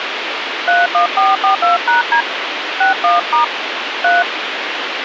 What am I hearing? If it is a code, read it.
DTMF, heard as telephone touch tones, dialled by hand, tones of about 130 ms, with radio hiss. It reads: 31442#D 61* 3